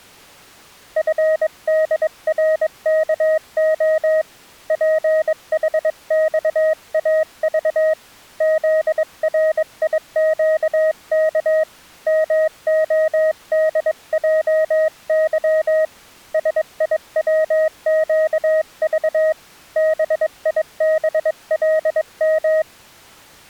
Morse code, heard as a keyed tone, hand-sent with a paddle, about 22 wpm, 630 Hz. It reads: FDRKO PHXAV ZRIQK MODJY SIWQV BIBLM